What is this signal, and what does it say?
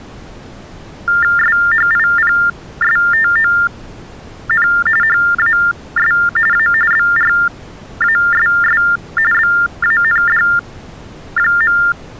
TTY/TDD text telephone tones (45.45 baud Baudot), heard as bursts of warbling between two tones, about 400 Hz shift, 1600 Hz centre. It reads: SHIPSTON HAS A BRASS BAND.